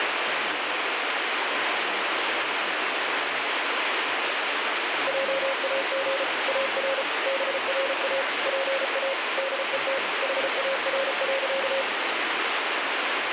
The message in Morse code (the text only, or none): JAG AR BRA PA DET HAR.